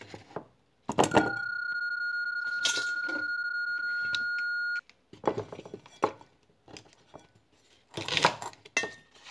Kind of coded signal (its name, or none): PSK31